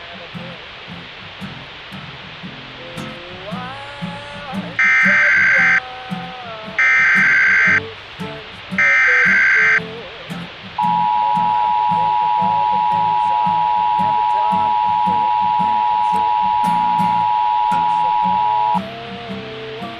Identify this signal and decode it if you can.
Emergency Alert System (SAME) tones (header bursts, then the 853 and 960 Hz attention tone), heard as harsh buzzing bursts, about 520.83 baud, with radio hiss.